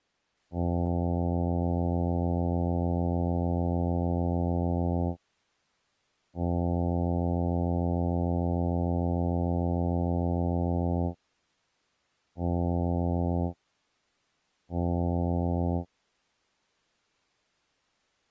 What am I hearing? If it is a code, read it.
Ship horn signal, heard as a ship's horn, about 90 Hz. 2 long, 2 short. At sea: I intend to overtake on your port side.